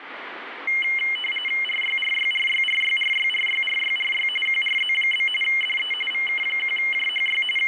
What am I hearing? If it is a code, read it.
RTTY (45.45 baud, 850 Hz shift), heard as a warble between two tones, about 2550 Hz centre, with radio static. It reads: RYRYRYRYRYRYRYRY QRZ? DE VK1JHY …